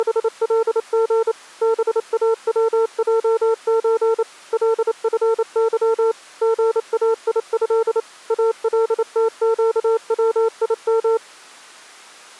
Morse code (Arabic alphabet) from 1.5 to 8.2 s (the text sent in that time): باوجز لفظ غايه